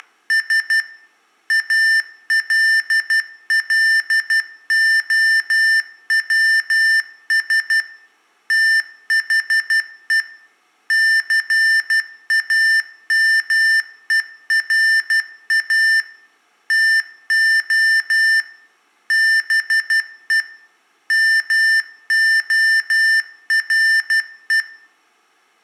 Morse code, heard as electronic beeps, machine-sent, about 12 wpm, 1800 Hz, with room echo. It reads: … ALLOWS THE CAMERA TO BE MORE